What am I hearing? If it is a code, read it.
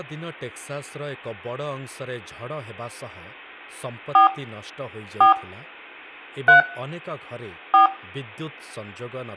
DTMF, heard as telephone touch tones, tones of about 120 ms, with room echo and speech in Odia. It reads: 4 4 3 4